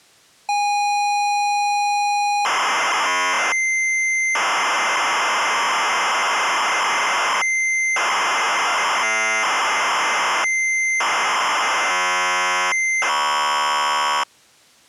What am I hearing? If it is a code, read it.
ZX Spectrum tape loading, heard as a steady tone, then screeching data.